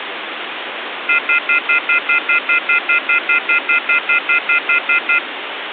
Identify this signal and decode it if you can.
Telephone call progress tone (North American plan), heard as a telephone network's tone, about 1400, 2050, 2450, 2600 Hz, 0.1 s on and 0.1 s off, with phone line noise. Off-hook warning tone.